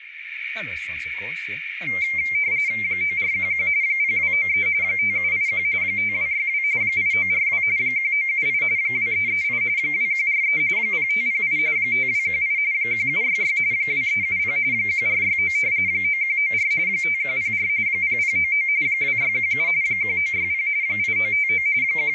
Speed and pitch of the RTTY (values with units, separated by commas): 45.45 baud, 170 Hz shift, 2200 Hz centre